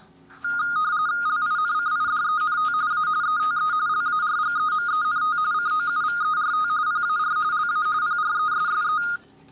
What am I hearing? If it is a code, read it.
RTTY (45.45 baud, 170 Hz shift), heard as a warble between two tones, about 1330 Hz centre, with the noise of a restroom. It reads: LINCIDENT A ETE LARGEMENT COUVERT PAR LA PRESSE